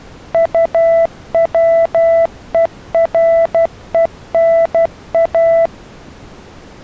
Morse code (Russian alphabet), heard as a keyed tone, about 12 wpm, 660 Hz. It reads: УВЕРЕНА